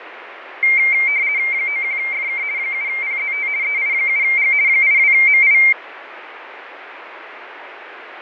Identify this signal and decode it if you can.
RTTY (50 baud, 170 Hz shift), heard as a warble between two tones, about 2200 Hz centre, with radio static and fading. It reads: 91FK 7PZT EI7G 82MI